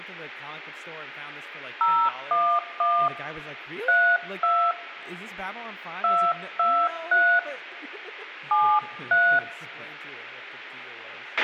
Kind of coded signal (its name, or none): DTMF